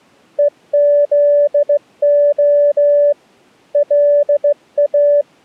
Morse code (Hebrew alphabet), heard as a keyed tone, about 16 wpm, 580 Hz. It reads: וזה לא